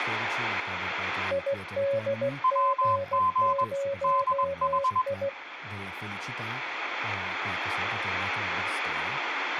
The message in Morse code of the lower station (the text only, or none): IDG0I